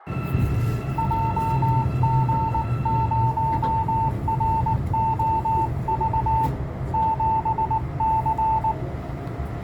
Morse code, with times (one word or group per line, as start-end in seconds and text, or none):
1.0-6.5 JG0ROV
6.9-8.7 7C